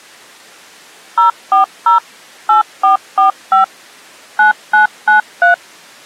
DTMF, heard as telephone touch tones, dialled by machine, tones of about 120 ms. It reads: 040 8445 9993